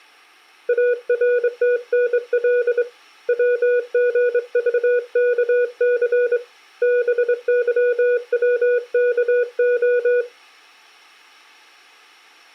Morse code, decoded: ARTNL WGVKC BYWKO

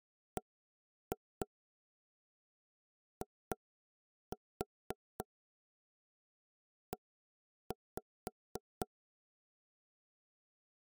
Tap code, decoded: BIE

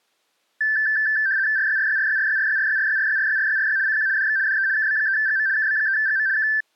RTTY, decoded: RYRYRYRYRYRYRYRYRYRYRY CQ DX DE KB3GM KB3GM K

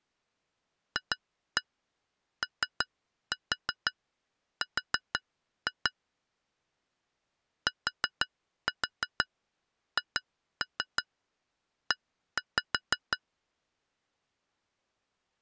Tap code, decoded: FOR THE

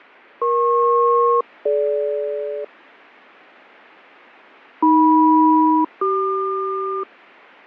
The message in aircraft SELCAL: EP-DG AM-CQ

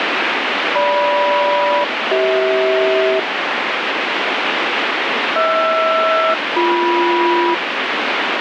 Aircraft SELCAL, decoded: GM-CH HR-BM

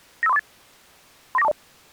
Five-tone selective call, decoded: 95348 39420

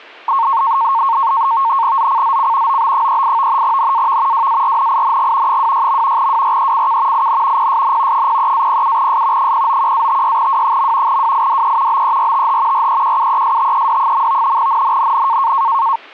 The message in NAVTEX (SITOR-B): ZCZC OB38 NAV WARNING 26. WRECK IN PSN 03-07S 091-56W. WIDE BERTH REQUESTED. NNNN

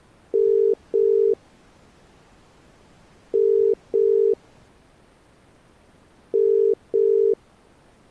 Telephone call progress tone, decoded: ringback tone

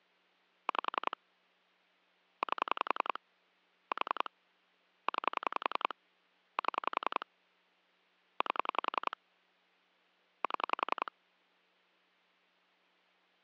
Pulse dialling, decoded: 5 8 4 9 7 8 7

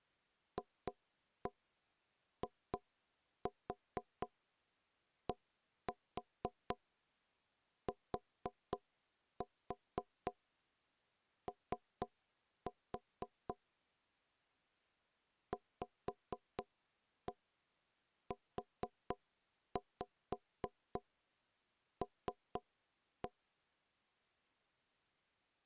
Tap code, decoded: FIDTO VUL

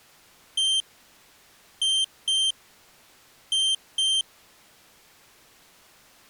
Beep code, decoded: 1-2-2

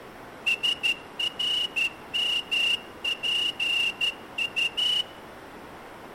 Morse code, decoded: SRMPU

